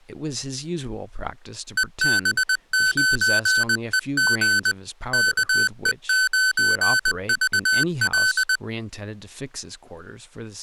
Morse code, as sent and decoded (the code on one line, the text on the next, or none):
. -... ----. . --. / -.- . ----. ...- .-..
EB9EG KE9VL